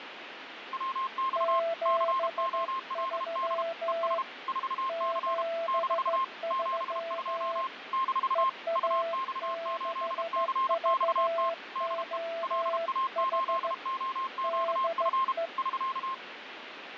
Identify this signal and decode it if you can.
Morse code, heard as two keyed tones, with radio static and fading. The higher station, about 32 wpm, 1060 Hz: WX COLD ES 4C - 72 - UX8CXT DE LA8OQF <SK>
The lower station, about 15 wpm, 670 Hz: 73 73 EA6VOH DE